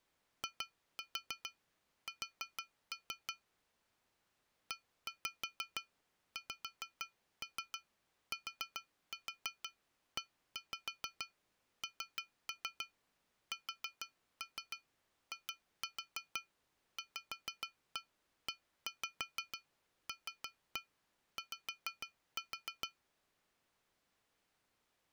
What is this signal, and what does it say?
Tap code, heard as taps on glass, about 6 knocks a second. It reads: IS EXTENSIVELY